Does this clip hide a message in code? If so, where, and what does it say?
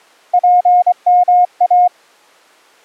Yes: Morse code (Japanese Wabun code) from 0.3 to 1.9 s, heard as a keyed tone, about 24 wpm, 720 Hz. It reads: ツヨイ